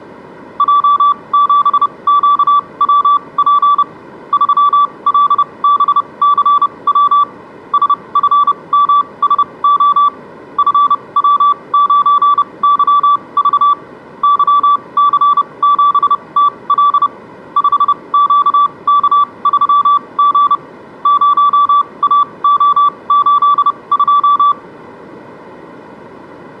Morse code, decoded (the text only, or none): J7QWP 3LBCW SFMSO FW9YV YC7TL 5QK3G 0AO82